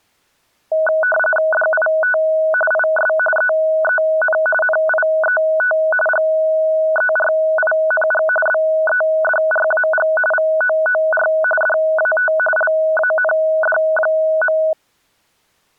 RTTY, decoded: DIT IS EEN NIET GERING BEDRAG VOOR DAT LAND.

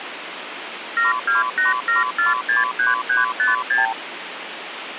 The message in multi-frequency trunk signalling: 7287463356

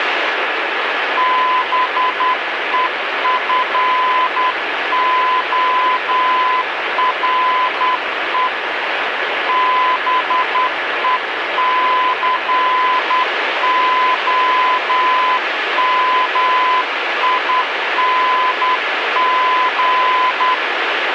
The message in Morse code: BEFORE BECOMING

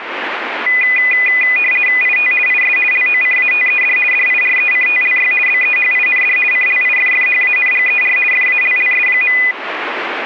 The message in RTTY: IT IS LOCATED DIRECTLY BEHIND CLIFFHANGER FALLS.

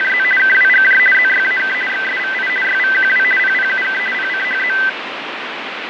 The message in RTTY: … KWGJ ZYAK XSVI YVQW PPUK PCHZ

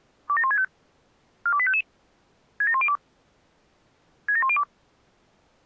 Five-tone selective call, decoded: 27165 42855 67102 67102

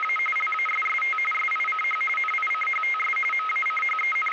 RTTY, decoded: … LASST SICH NICHTS …

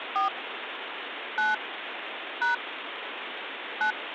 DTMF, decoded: 4 9 # 9

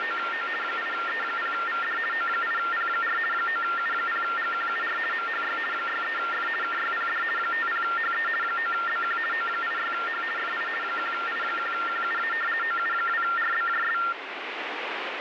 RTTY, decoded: … 8E0VD O8P4 9U0GQUR MHY 63F KYPD 50HE 9BQ O86H FI 1I1QUA OU2RBJS

